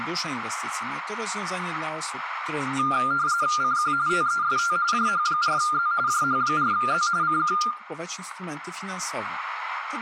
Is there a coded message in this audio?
Yes: RTTY (45.45 baud, 170 Hz shift) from 2.8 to 7.7 s, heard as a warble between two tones, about 1300 Hz centre, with radio static and room echo. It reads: CQ TEST JH4Z JH4Z CQ